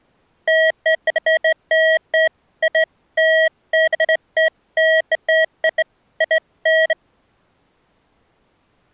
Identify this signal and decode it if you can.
Beeps of irregular length. There is no code.